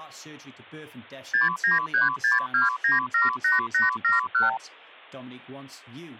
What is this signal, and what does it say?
Multi-frequency trunk signalling (R2, with the far end's replies), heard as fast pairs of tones, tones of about 150 ms, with hum and speech in English. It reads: 69362978871